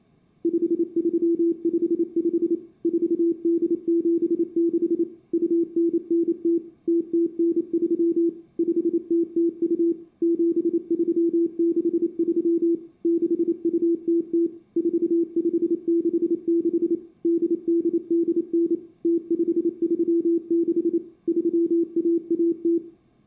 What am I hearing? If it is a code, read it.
Morse code (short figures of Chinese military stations), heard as a keyed tone, machine-sent, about 28 wpm, 340 Hz, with room echo. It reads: 5355 4876 2990 0093 5002 7363 6200 4566 8889 0536 3110